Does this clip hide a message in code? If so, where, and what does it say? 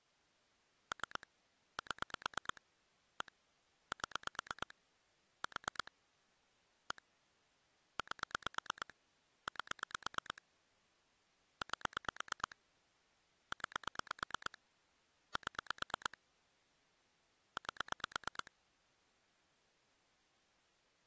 Yes: pulse dialling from 0.9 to 18.5 s, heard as clicks on a phone line, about 8 pulses a second. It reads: 3 7 1 7 4 1 8 8 8 9 7 8